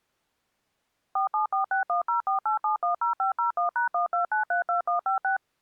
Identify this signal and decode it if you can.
DTMF, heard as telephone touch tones, dialled by machine, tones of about 120 ms. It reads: 47461048710501#12932156